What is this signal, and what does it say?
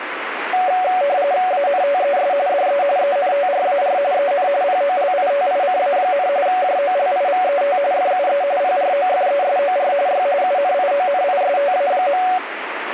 RTTY (45.45 baud, 170 Hz shift), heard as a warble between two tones, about 650 Hz centre, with radio static. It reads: ANTES DE ENTRAR EN POLITICA, JOLIVET FUE PROFESOR Y UNIONISTA.